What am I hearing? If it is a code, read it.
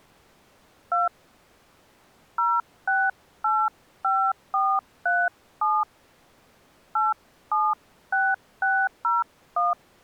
DTMF, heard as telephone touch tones, dialled by hand, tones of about 230 ms. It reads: 2 0685437 876601